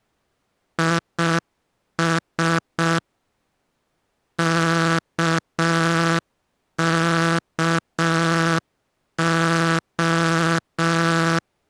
Morse code (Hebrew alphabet), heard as a buzzer, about 6 wpm. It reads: יש ככה